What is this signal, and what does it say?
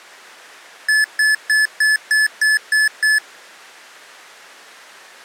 Beep code, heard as beeps from a small speaker, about 1750 Hz. 8 short. In AMI BIOS tables: display memory failure; in Dell tables: LCD failure.